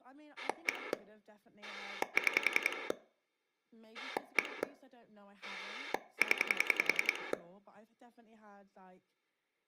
Pulse dialling, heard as a rotary dial, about 10 pulses a second, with speech in English. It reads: 1 6 1 0